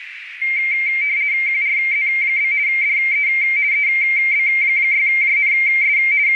RTTY (50 baud, 170 Hz shift), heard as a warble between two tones, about 2200 Hz centre, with radio static and a narrow filter. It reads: QRZ? DE EB6JNS …